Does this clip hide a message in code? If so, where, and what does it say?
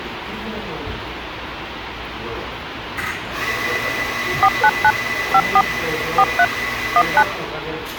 Yes: DTMF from 4.4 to 7.2 s, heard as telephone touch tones, dialled by machine, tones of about 60 ms, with phone line noise and the noise of a cafe. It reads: 499 54 43 19